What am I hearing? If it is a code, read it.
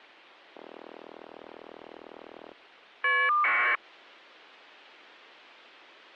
Caller ID data burst, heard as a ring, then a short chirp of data, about 1200 baud.